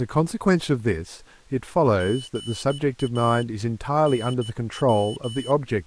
Morse code, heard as a high beeper, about 15 wpm, 3000 Hz, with speech in English. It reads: GA NW